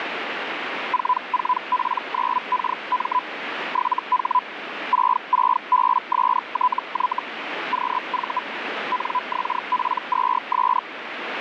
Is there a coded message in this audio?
Yes: Hellschreiber (Feld-Hell, 122.5 baud) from 0.9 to 10.8 s, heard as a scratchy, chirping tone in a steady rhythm, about 1000 Hz, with radio static. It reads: 44P9KM 7H 66BSTY QV NXP2S